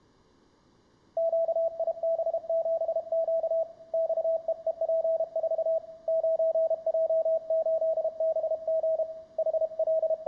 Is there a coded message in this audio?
Yes: Morse code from 1.1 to 10.3 s, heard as a keyed tone, hand-sent with a paddle, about 32 wpm, 650 Hz, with room echo. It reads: QIB7Q XEEP4 9J8BG …